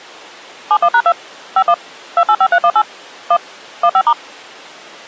DTMF, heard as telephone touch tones, dialled by machine, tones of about 60 ms. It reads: 71#2 51 285318 1 15*